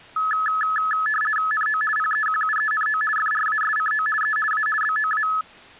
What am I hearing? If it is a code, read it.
RTTY (50 baud, 450 Hz shift), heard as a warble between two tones, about 1500 Hz centre. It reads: NO PEQUENO FRASCO E A BOA